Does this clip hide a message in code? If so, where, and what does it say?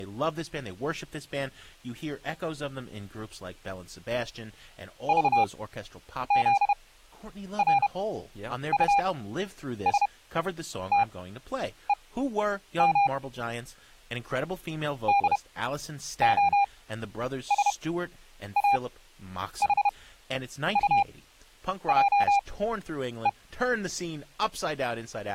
Yes: Morse code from 5.0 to 23.4 s, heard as a keyed tone, machine-sent, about 31 wpm, spaced as for 9 wpm, 800 Hz, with speech in English. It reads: VZRUSTEM DOSAHUJE